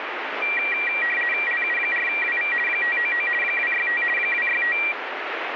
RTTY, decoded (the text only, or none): LU4WV 599 265 265